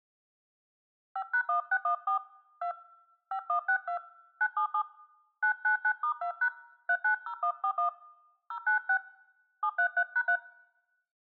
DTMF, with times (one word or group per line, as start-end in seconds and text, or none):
1.2-2.2 5#1614
2.6-2.7 2
3.3-4.0 5162
4.4-4.8 977
5.4-6.5 999*2#
6.9-7.9 390141
8.5-9.0 096
9.6-10.4 733#3